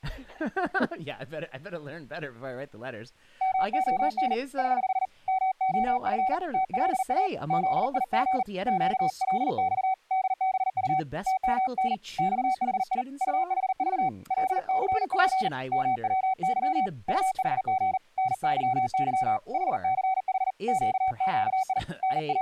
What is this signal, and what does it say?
Morse code, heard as a keyed tone, hand-sent with a paddle, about 39 wpm, 760 Hz, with speech in English. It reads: MON <HH> MOF TLA ZIG QLX DBU TMN XHI UHV LCP MWY UHG NYY HCH QQI …